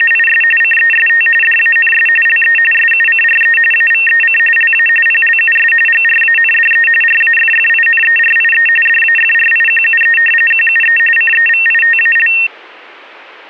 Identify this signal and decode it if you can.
RTTY (45.45 baud, 850 Hz shift), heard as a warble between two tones, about 2250 Hz centre. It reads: … CEST DANS LE SUCRE AVEC LA PLUS GRANDE RAFFINERIE DAFRIQUE QUE CEVITAL